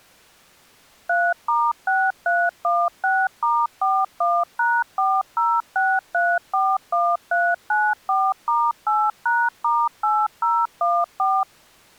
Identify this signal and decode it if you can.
DTMF, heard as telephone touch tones, dialled by machine, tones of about 240 ms. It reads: 3*6316*41#406341394*8#*8014